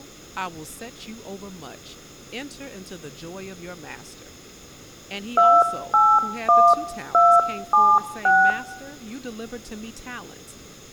DTMF, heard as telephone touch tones, dialled by hand, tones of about 250 ms, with room echo and speech in English. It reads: 281276